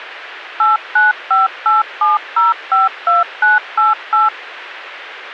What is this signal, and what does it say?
DTMF, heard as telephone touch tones, dialled by machine, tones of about 160 ms, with radio hiss. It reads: 89587052988